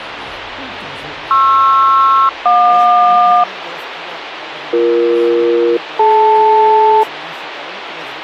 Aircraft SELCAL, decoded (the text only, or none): PR-JQ BE-DL